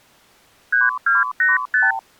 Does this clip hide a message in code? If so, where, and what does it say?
Yes: multi-frequency trunk signalling (R2, with the far end's replies) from 0.7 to 2.0 s, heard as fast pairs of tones, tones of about 170 ms. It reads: 3285